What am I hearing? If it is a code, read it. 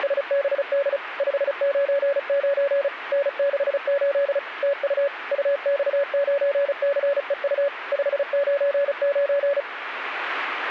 Morse code, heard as a keyed tone, machine-sent, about 35 wpm, 560 Hz. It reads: … 599 N68 TU UX9CEU 599